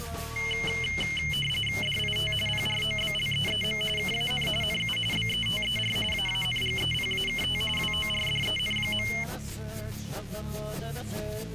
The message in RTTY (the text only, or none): DIT PROBLEEM KAN NU BETER AANGEPAKT WORDEN.